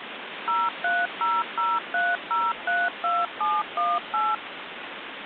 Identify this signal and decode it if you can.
DTMF, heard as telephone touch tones, dialled by machine, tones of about 210 ms, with phone line noise. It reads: 03003032718